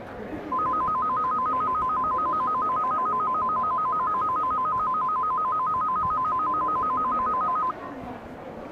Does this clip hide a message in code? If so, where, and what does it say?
No, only a tone that alternates evenly between two pitches, with the noise of a crowd indoors.